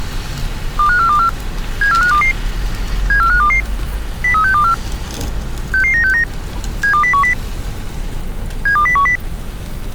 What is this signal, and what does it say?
Five-tone selective call (CCIR), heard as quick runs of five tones, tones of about 100 ms, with street noise. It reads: 25424 74522 74522 03624 66969 72010 72010